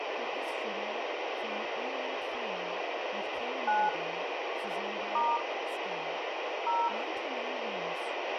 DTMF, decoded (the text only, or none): 9 * 0